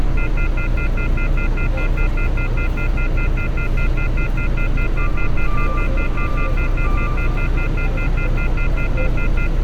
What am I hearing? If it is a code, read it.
Telephone call progress tone (North American plan), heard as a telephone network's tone, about 1400, 2050, 2450, 2600 Hz, 0.1 s on and 0.1 s off, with street noise. Off-hook warning tone.